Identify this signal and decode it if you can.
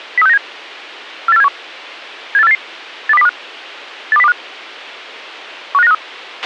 Five-tone selective call (EEA), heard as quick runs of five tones, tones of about 40 ms, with a squelch burst at the end. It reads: 03697 48471 78488 82025 82025 15953